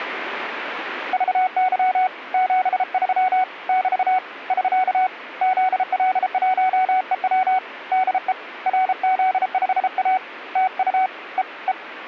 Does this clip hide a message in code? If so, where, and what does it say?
Yes: Morse code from 1.1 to 11.8 s, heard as a keyed tone, hand-sent with a paddle, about 33 wpm, 750 Hz. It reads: VY 73 <BT> <SK> ZL1EW DE RZ5A TU E E